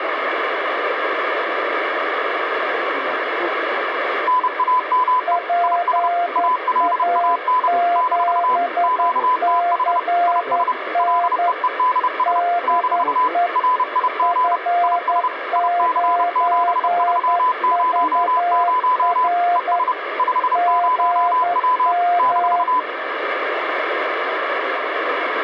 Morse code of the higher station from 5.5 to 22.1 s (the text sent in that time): IS ALAN - QTH IS LEEDS - RIG IS IC7300 ES 50W